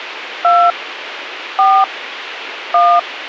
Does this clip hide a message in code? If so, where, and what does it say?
Yes: DTMF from 0.4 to 3.0 s, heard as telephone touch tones, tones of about 260 ms, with radio hiss. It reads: 2 4 1